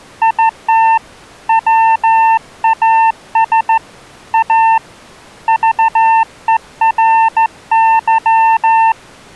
Morse code, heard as a keyed tone, hand-sent with a straight key, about 14 wpm, 900 Hz. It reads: IT WAS A VERY